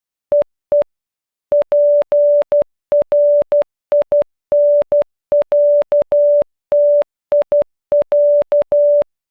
Morse code (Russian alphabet), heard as a keyed tone, machine-sent, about 12 wpm, 580 Hz. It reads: ЕЕ ПРИНЯТИЯ